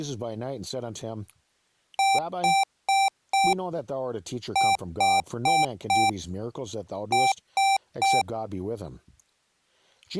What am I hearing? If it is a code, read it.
Beep code, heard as beeps from a small speaker, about 780 Hz, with speech in English. 4-4-3. In Phoenix BIOS tables: maths coprocessor failure.